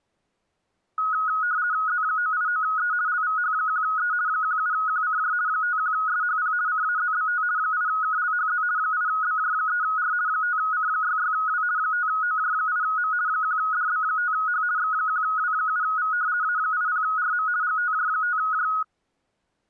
RTTY (50 baud, 170 Hz shift), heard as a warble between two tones, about 1360 Hz centre. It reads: Z989E LVH1E 17QCJ 51SHP CAZBT 8KLHZ 8BJ3R 5C66W 5OJ8M 1DB5H X1W7V A80RM GTJ5J